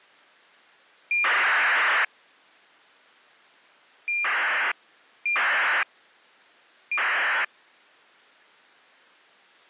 ACARS aircraft data, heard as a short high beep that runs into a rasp, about 2400 baud.